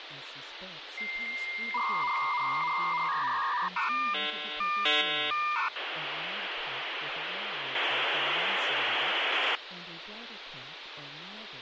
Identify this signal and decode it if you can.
Dial-up modem handshake (V.34 or later), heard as a whistle, warbles, then hiss, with phone line noise and speech in English.